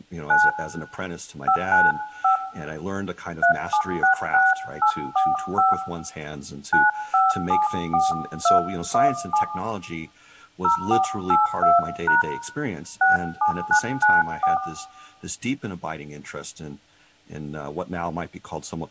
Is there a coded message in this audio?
Yes: DTMF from 0.3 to 14.6 s, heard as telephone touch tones, dialled by hand, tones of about 140 ms, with room echo and speech in English. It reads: 9 595 3766845 9574217 0482# 67994